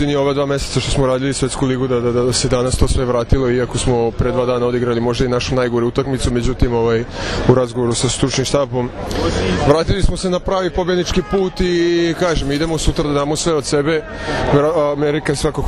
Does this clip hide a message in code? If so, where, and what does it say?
No.